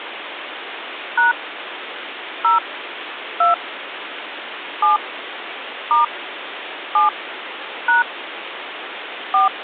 DTMF, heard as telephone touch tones, dialled by hand, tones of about 140 ms, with phone line noise. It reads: # 0 2 7 * 7 # 4